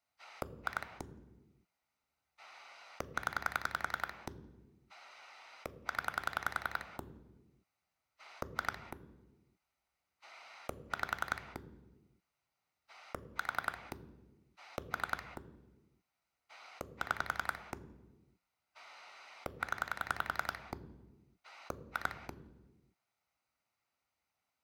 Pulse dialling, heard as a rotary dial, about 10 pulses a second. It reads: 2 0 0 2 5 4 3 6 0 2